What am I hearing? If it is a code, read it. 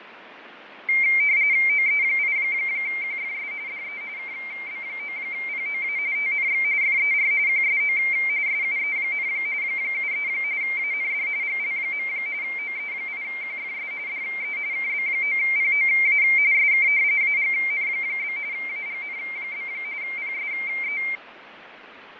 RTTY (45.45 baud, 170 Hz shift), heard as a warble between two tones, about 2200 Hz centre, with radio static and fading. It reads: OE8QFS DE KB9POA TNX FER QSO SUE, 73 AND GL. OE8QFS DE KB9POA SK AGN? AGN? PSE